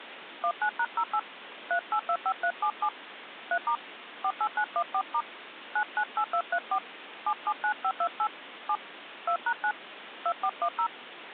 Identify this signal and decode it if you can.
DTMF, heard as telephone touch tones, dialled by hand, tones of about 70 ms, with phone line noise. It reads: 19#08 3825377 3* 48914* 998234 779528 7 2#9 2410